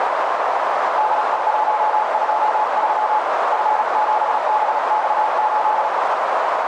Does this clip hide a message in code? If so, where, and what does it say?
Yes: Morse code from 0.9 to 5.9 s, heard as a keyed tone, hand-sent with a paddle, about 36 wpm, 860 Hz, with heavy radio static and a narrow filter. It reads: DE123 F7BX8